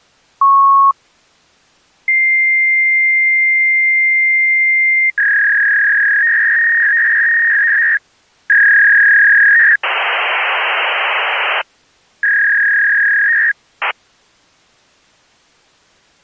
Fax machine handshake, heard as a beep, a long tone, a warble and hiss.